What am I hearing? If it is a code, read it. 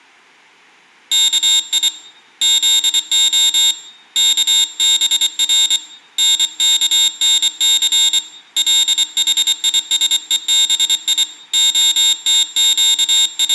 Morse code (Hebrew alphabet), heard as a high beeper, hand-sent with a paddle, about 24 wpm, 3700 Hz, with room echo. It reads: כי זה כבר נכנס לחישובי …